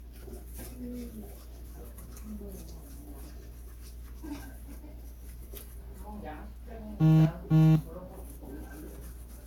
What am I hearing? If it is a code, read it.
Kitchen noise. There is no code.